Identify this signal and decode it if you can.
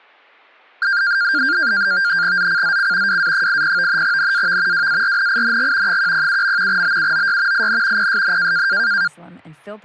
NAVTEX (SITOR-B), 100 baud, 170 Hz shift, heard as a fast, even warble, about 1500 Hz centre, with speech in Spanish. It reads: ZCZC WA80 NAV WARNING 107. BUOY IN PSN